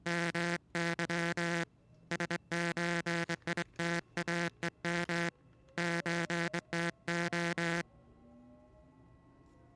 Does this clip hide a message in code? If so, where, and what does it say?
Yes: Morse code (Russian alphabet) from 0.0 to 7.9 s, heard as a buzzer, hand-sent with a straight key, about 23 wpm, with the noise inside a subway train. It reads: МЫ СЧИТАЕМ ЧТО